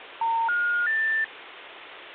Telephone call progress tone (North American plan), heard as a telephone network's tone, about 910, 1430, 1800 Hz, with phone line noise. Special information tone.